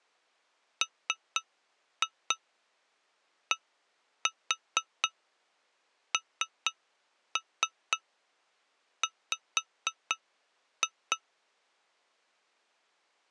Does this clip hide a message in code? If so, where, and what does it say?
Yes: tap code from 0.8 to 11.2 s, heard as taps on glass, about 4 knocks a second. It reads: MDNW